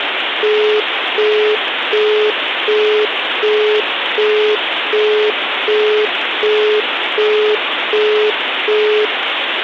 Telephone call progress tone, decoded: busy tone

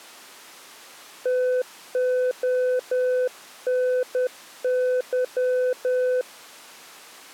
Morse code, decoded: TONY

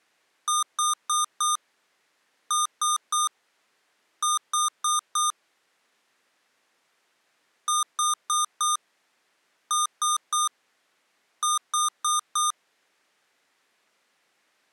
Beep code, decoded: 4-3-4

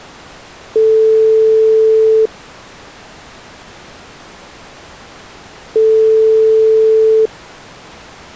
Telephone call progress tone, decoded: ringback tone

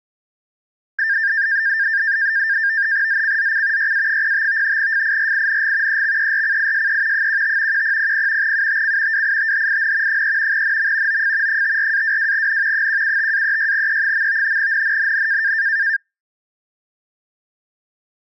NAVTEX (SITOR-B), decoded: ZCZC YA05 FIRING EXERCISE 15 1000 UTC WITHIN 3 NM OF 54-22N 175-36E. NNNN

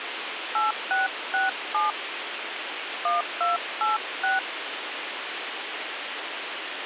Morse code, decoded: none

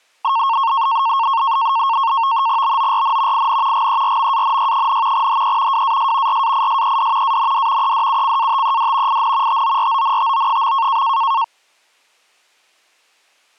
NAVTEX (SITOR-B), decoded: BORN IN GERMANY, HE WAS RAISED AND EDUCATED IN TORONTO.

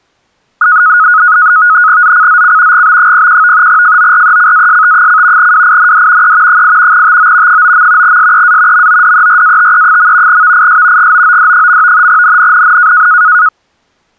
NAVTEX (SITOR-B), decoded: ZCZC GB01 FORECAST: WIND E 8 TO 9. SEA MODERATE. VIS GOOD. NNNN

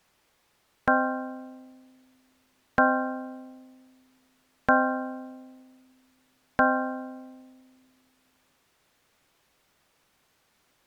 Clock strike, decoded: 4

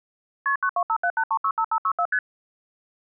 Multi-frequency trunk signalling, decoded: KP 92578365564 ST

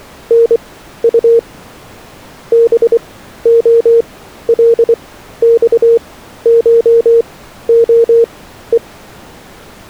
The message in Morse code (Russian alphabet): НУ БОЛЬШОЕ

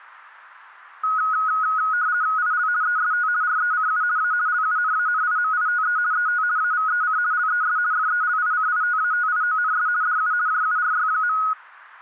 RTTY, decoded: IL EST RECU A LUNANIMITE ET AVEC LES FELICITATIONS DU JURY.

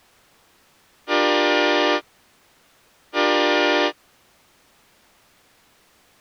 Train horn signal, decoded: 2 short

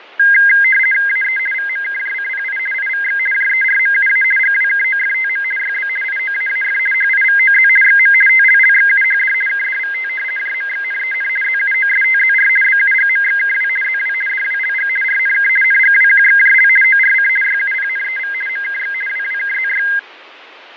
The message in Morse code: none

